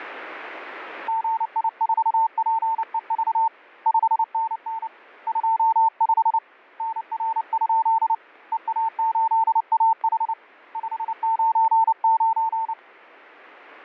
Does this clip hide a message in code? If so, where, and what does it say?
Yes: Morse code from 1.0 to 12.8 s, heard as a keyed tone, hand-sent with a paddle, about 29 wpm, 900 Hz, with static crashes. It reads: GI4PEV 5NN 25 NR? EA8AH 599